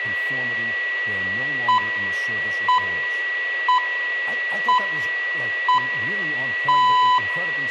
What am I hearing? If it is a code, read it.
Radio time signal (six pips, as the Greenwich Time Signal), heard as pips, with a steady whistle near 1940 Hz, room echo and speech in English.